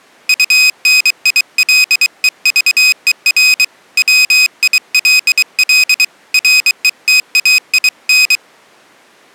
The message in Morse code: UNILEVER WILL RETAIN

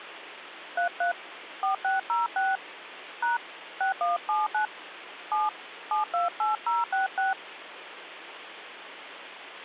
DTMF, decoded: 33 4606 # 6179 7 728066

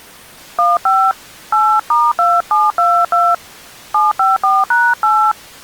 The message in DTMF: 15 8*2722 754#8

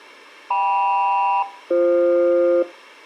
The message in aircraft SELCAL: KM-BF

